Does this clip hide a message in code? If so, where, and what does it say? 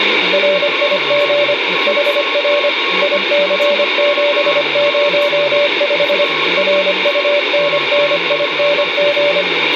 Yes: Morse code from 0.3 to 9.5 s, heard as a keyed tone, machine-sent, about 25 wpm, 580 Hz, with radio static, a weaker station near 1090 Hz and speech in English. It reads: RIG HR IC705 RUNNING